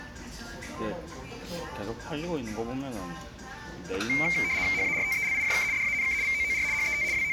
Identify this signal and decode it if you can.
RTTY (75 baud, 170 Hz shift), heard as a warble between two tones, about 2200 Hz centre, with room echo and the noise of a restaurant. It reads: HARTELIJK DANK VOOR HET …